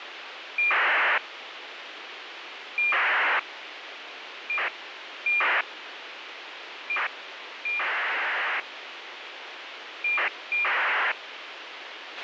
ACARS aircraft data, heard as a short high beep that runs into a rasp, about 2400 baud, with radio hiss and a squelch burst at the end.